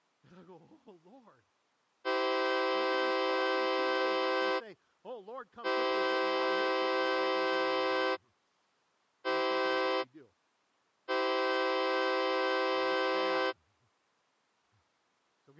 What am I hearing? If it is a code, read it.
Train horn signal, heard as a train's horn, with speech in English. 2 long, 1 short, 1 long. On North American railways: approaching a public crossing.